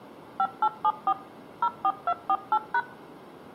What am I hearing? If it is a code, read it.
DTMF, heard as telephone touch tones, dialled by machine, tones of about 60 ms, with room echo. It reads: 5874 04248#